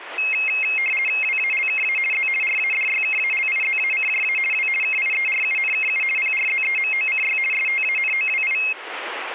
RTTY (50 baud, 450 Hz shift), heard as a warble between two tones, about 2350 Hz centre. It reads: WALKA Z RADYKALIZACJA W KIERUNKU PRZEMOCY STANOWI